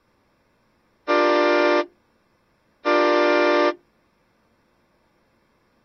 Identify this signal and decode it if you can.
Train horn signal, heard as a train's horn. 2 short. On North American railways: a signal is acknowledged.